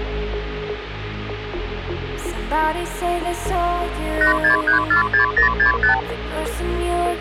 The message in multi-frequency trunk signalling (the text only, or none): 86346065